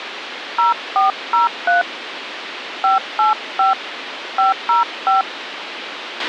DTMF, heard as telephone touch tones, dialled by hand, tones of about 140 ms, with radio hiss and a squelch burst at the end. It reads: 0403 585 505